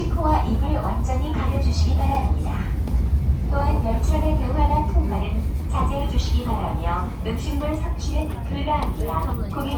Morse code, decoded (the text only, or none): none